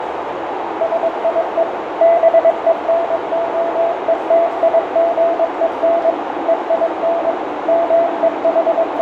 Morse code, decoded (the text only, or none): SIE BENOETIGEN EIN …